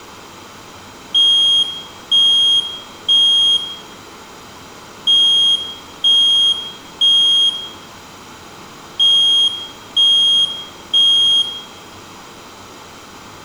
Alarm pattern, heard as an alarm's beeps, played three times, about 3250 Hz, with room echo. Temporal three. Smoke or fire, evacuate.